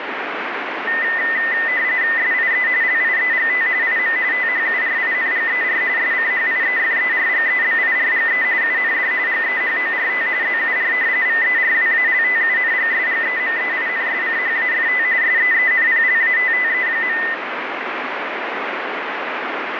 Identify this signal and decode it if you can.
RTTY (45.45 baud, 170 Hz shift), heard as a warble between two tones, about 1900 Hz centre, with radio static. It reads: SIE LIEGT IM THURINGER SCHIEFERGEBIRGE UND GEHORT ZUR VERWALTUNGSGEMEINSCHAFT SEENPLATTE.